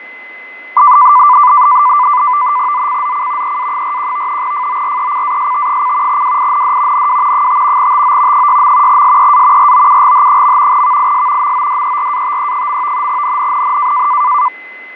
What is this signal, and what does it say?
NAVTEX (SITOR-B), 100 baud, 170 Hz shift, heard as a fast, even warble, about 1090 Hz centre, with fading and a steady whistle near 2040 Hz. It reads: ZCZC EA41 FORECAST: WIND NW 5 TO 6. SEA ROUGH. VIS MODERATE. NNNN